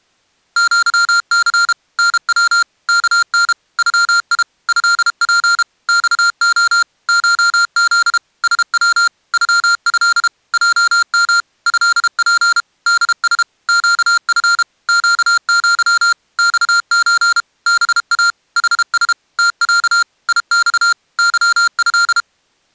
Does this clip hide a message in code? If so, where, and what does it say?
Yes: Morse code (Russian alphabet) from 0.5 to 22.3 s, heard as electronic beeps, machine-sent, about 32 wpm, 1390 Hz. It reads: ЪЦ НВ КН ЮИ ЭП ЬО ШЗ СВ ЮЭ ЙМ ЭП ДС ЩФ ЩЪ ЬЧ БА ХС ТЯ ИЬ ЫЭ